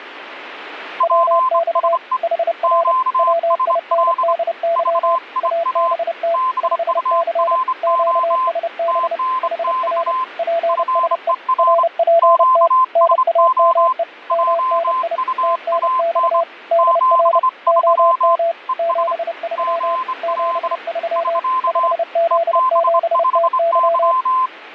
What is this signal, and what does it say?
Morse code, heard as two keyed tones, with radio static. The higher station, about 26 wpm, 1030 Hz: PSE QSL VIA BURO TNX FER QSO JUAN 73 ES GL <SK> EB5Y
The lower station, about 30 wpm, 670 Hz: WX HR WINDY ABT 5C QSB HR PSE RPT NAME MNI TNX DR OM 73 73 5Z7TY